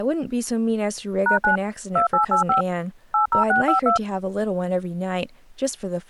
DTMF, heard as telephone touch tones, dialled by machine, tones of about 120 ms, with speech in English. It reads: #9 2885 80652